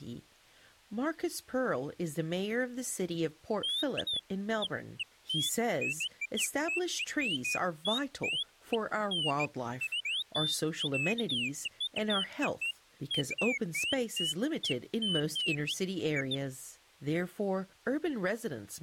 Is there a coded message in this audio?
No, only bird-like chirps, with speech in English.